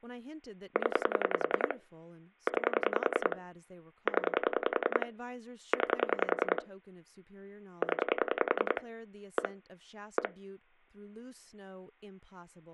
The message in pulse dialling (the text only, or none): 0 9 0 9 0 1 1